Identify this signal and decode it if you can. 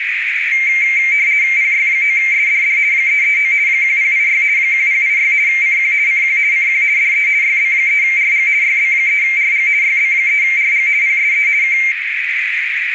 RTTY (50 baud, 170 Hz shift), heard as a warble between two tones, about 2200 Hz centre, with radio static and a narrow filter. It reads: PY9SDD 339 1086 1086 CQ CQ CQ DE YB3RG YB3RG YB3RG PSE K